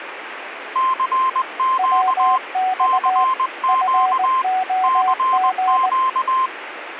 Morse code, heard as two keyed tones, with radio static. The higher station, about 20 wpm, 1050 Hz: CQ CQ CQ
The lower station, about 19 wpm, 750 Hz: WX FOG